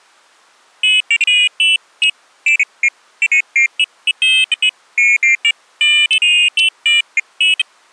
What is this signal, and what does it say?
Pairs of high tones at irregular times. There is no code.